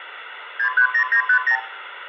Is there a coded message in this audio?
Yes: multi-frequency trunk signalling (R2, with the far end's replies) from 0.6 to 1.6 s, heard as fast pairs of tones, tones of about 90 ms, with phone line noise and room echo. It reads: 630950